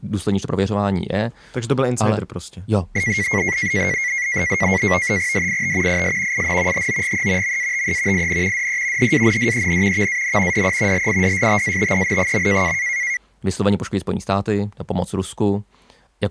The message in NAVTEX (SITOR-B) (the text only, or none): DIT IS IN HOGE MATE IN DE HANDEN VAN DE LIDSTATEN.